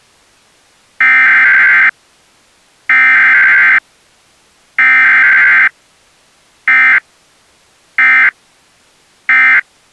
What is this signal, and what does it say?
Emergency Alert System (SAME) tones (header bursts, then end-of-message bursts), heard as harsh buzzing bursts, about 520.83 baud.